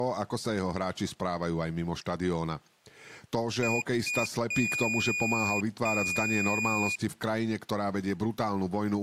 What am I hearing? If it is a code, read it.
Beep code, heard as a piezo beeper, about 2450 Hz, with speech in Slovak. 2 short, 2 long.